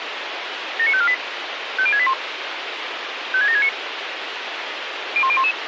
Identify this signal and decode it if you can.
Five-tone selective call (ZVEI), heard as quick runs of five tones, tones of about 70 ms, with radio hiss. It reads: 79548 50681 56769 01011